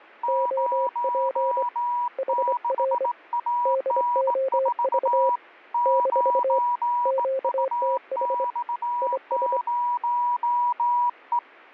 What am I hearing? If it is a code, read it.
Morse code, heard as two keyed tones. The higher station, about 18 wpm, 970 Hz: 06AN4 9UX0E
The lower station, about 24 wpm, 530 Hz: OP HR DOV - QTH IS